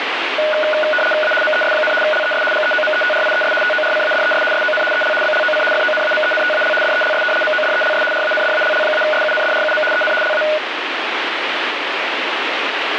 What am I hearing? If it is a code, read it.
RTTY (75 baud, 850 Hz shift), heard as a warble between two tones, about 1040 Hz centre, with radio static. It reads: A MES, LES GEOMETRIES TORCADES SON EL BLOC FONAMENTAL DELS MODELS RANDALL-SUNDRUM EN LA